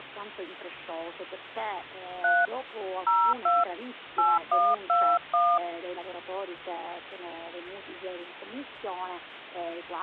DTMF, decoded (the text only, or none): 3 02 8121